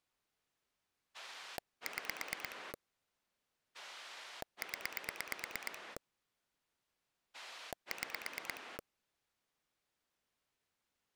Pulse dialling, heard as a rotary dial, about 9 pulses a second. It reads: 6 0 6